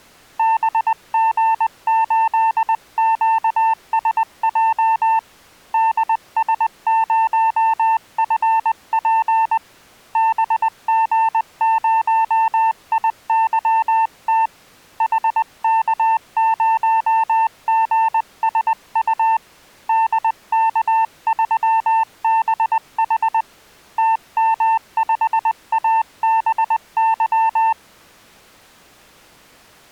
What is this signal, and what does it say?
Morse code, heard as a keyed tone, hand-sent with a paddle, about 20 wpm, 900 Hz. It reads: BG8QSJ DS0FP BG0IYT HK0GSU DK3BH TM5ABY